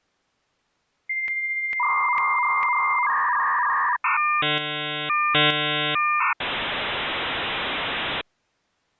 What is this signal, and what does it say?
Dial-up modem handshake (V.34 or later), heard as a whistle, warbles, then hiss.